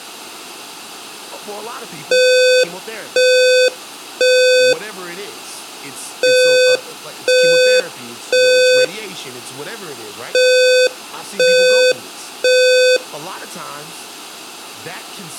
Alarm pattern, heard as an alarm's beeps, played three times, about 510 Hz, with speech in English. Temporal three. Smoke or fire, evacuate.